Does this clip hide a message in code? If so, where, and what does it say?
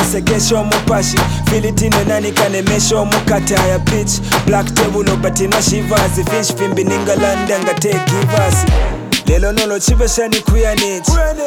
No.